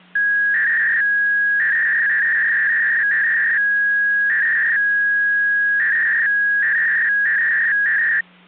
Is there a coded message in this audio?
Yes: 300-baud modem data (V.21 tones) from 0.2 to 8.2 s, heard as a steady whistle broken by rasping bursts, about 300 baud, 200 Hz shift, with hum.